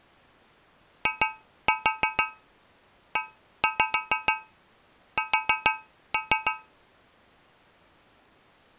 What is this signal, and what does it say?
Tap code, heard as taps on a metal pipe, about 6 knocks a second. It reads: IES